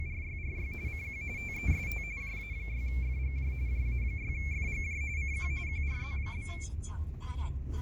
RTTY (45.45 baud, 170 Hz shift), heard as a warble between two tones, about 2250 Hz centre, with fading and the noise inside a car. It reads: … CQ TEST JA6FGJ JA6FGJ CQ QRZ?